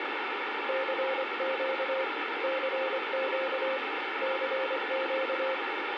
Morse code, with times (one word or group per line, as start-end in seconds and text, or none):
0.7-2.0 CQ
2.4-3.8 CQ
4.2-5.5 CQ